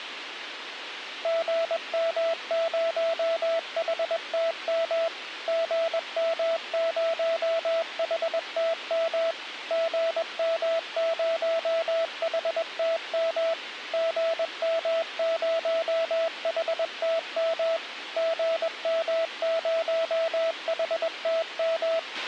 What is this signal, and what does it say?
Morse code, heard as a keyed tone, machine-sent, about 21 wpm, 660 Hz, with radio hiss and a squelch burst at the end. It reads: GM0HTM GM0HTM GM0HTM GM0HTM GM0HTM